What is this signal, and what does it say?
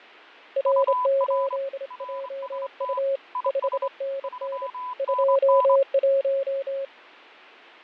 Morse code, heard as two keyed tones, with radio static and fading. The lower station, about 27 wpm, 550 Hz: R8JU 5NN 21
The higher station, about 25 wpm, 1000 Hz: UR RST IS 3NN